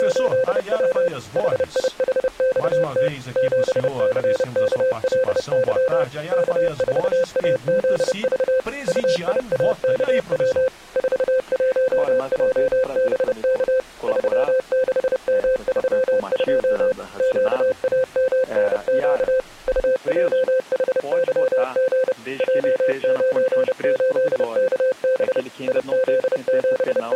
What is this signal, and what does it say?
Morse code, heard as a keyed tone, machine-sent, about 30 wpm, 520 Hz. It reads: … HIHXT 7CKLY K4AZV UIAKW 41JBK 36M32 QAMNQ UJHYG J98KB …